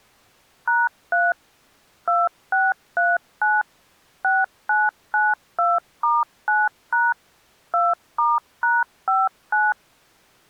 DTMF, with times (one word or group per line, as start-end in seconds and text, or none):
0.7-1.3 #3
2.1-3.6 2639
4.2-7.1 6992*9#
7.7-9.7 2*#59